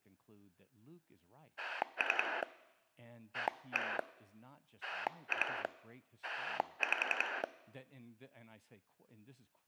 Pulse dialling, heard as a rotary dial, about 11 pulses a second, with speech in English. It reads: 3 1 2 5